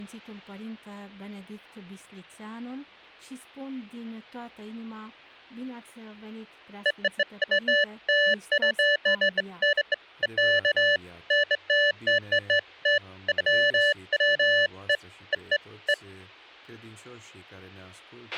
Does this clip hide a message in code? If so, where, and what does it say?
No, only beeps of irregular length, with a squelch burst at the end.